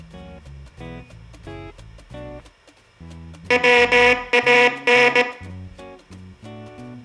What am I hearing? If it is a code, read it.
Morse code (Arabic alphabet), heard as a buzzer, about 18 wpm, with room echo. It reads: وان